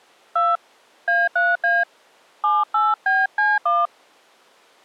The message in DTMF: 2 A3A 78BC1

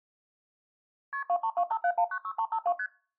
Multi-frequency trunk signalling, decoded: KP 23257196352 ST

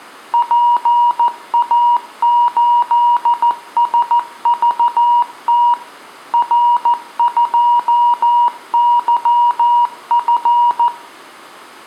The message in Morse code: PA8SVT R2YF

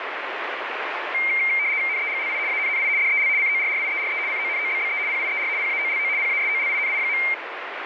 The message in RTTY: NEGLI ANNI DEL CORRIERE CONOBBE PIER PAOLO PASOLINI.

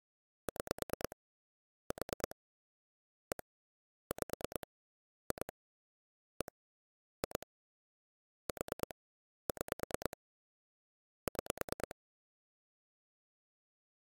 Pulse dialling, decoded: 6 4 1 5 2 1 2 4 6 6

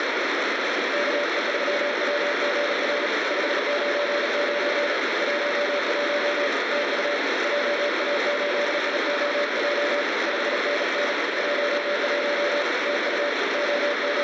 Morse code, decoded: KE3WGR 599 11 TU JA8IOJ 5NN 11 TU …

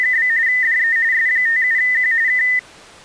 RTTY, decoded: … DE S57Q K

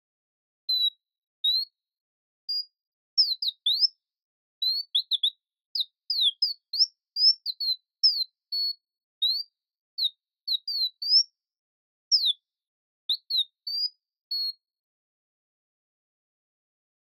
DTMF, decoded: none

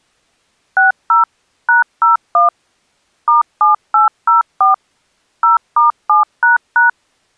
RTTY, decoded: none

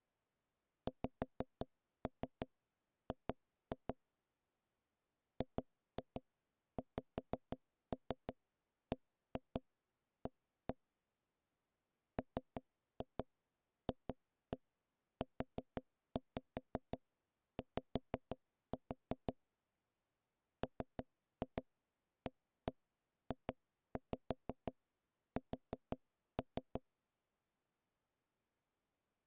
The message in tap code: XG GXBA MFUY MAJS

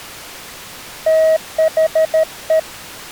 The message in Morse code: THE

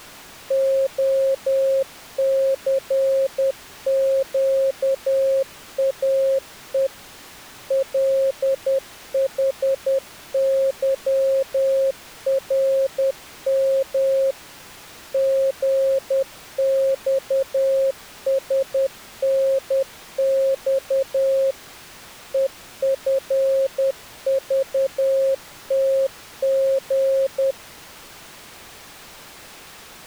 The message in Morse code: OCQAE LHYRM GXSNX EFVTG

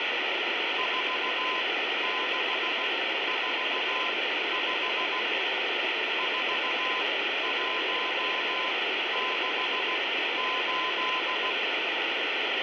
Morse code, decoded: 4645 4168

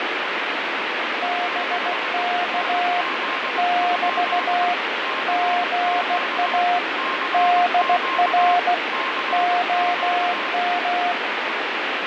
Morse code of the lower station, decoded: BK <BT> GA DR OM

